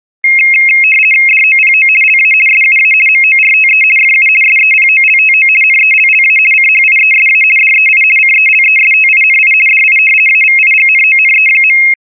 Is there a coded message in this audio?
Yes: RTTY (50 baud, 450 Hz shift) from 0.2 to 11.9 s, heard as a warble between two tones, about 2350 Hz centre. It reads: DOPO LA SUA MORTE FU SEPOLTO NELLA CHIESA DEI CELESTINI DI AVIGNONE.